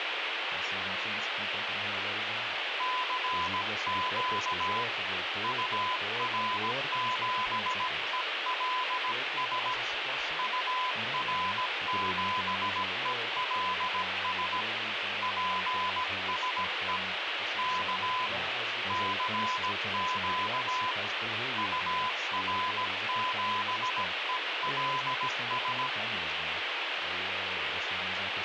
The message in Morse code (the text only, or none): CQ UR7ELS UR7ELS PSE K CQ UR7ELS